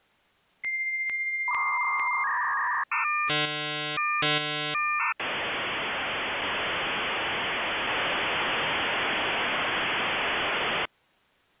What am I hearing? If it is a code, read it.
Dial-up modem handshake (V.34 or later), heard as a whistle, warbles, then hiss.